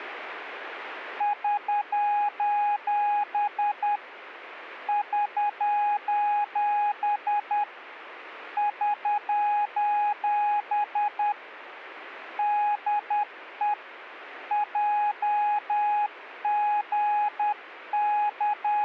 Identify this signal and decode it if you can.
Morse code, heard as a keyed tone, hand-sent with a paddle, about 10 wpm, 830 Hz. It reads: <SOS> <SOS> <SOS> DE …